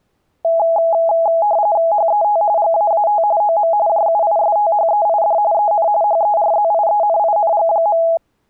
RTTY (45.45 baud, 170 Hz shift), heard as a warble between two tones, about 750 Hz centre. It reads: HET GAAT OM JUISTHEID EN HERZIENING.